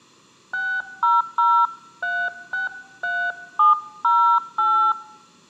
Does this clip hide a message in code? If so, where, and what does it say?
Yes: DTMF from 0.5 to 4.9 s, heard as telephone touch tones, dialled by hand, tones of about 230 ms. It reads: 600363708